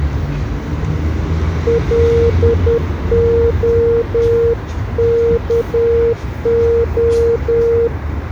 Morse code, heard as a keyed tone, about 10 wpm, 460 Hz, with the noise of a residential street. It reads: LOKO